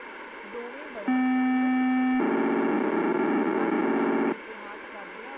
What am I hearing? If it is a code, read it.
POCSAG pager data (512 baud), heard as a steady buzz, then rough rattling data, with radio hiss and speech in Punjabi.